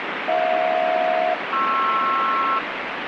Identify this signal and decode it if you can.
Aircraft SELCAL, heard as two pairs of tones, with radio static. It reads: HJ-PR